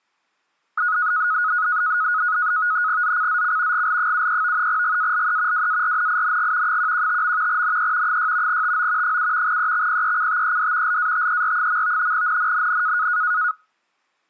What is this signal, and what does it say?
NAVTEX (SITOR-B), 100 baud, 170 Hz shift, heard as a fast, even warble, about 1360 Hz centre. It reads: ZCZC GL73 GALE WARNING 115. NE 6 TO 7 EXPECTED LATER. NNNN